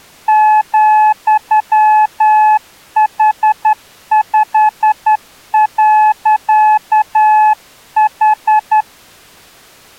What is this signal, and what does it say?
Morse code, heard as a keyed tone, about 10 wpm, 860 Hz. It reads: ,H5.H